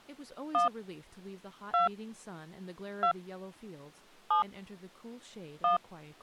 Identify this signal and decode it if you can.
DTMF, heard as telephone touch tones, dialled by hand, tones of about 120 ms, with speech in English. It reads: 1 2 2 7 1